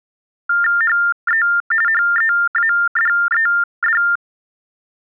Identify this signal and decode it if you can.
TTY/TDD text telephone tones (45.45 baud Baudot), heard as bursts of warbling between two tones, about 400 Hz shift, 1600 Hz centre. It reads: HE HEADED